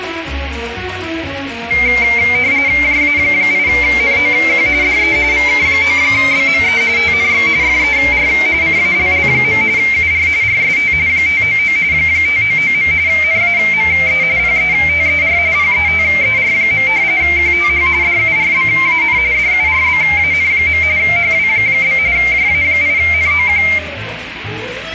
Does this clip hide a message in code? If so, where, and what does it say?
Yes: RTTY (45.45 baud, 170 Hz shift) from 1.7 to 23.8 s, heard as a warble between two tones, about 2200 Hz centre, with radio static and room echo. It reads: JA8NOQ DE VK9BME TNX FER CALL. UR RST 599 599. NAME PETER PETER. QTH DURBAN DURBAN. HW? JA8NOQ